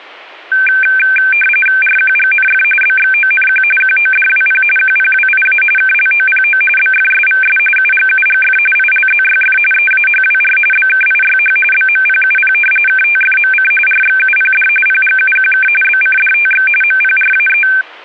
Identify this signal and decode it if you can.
RTTY (45.45 baud, 850 Hz shift), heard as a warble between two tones, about 1950 Hz centre. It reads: RQGNF BXONQ QODWP QPWIA KLOPO BFSVS UGUGF ILZYF EAHWR BKIYH BMPUP KTFMC RXUPD PGUQK BCDTX MPRAE